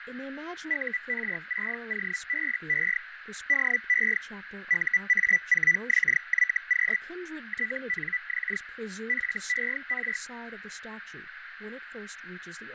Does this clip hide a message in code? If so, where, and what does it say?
Yes: Hellschreiber (Feld-Hell, 122.5 baud) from 0.7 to 10.2 s, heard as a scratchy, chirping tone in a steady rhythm, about 2000 Hz, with radio static, fading, a narrow filter and speech in English. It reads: UR6OBE DE UA4XYQ TNX FER